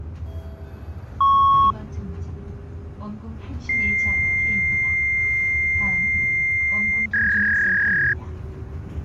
Fax machine handshake, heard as a beep, a long tone and a warble, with the noise inside a bus.